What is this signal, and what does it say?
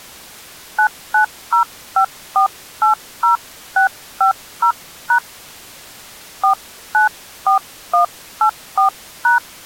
DTMF, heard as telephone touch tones, dialled by hand, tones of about 110 ms. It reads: 9905480650# 494184#